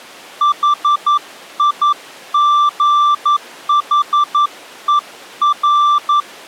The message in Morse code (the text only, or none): HIGHER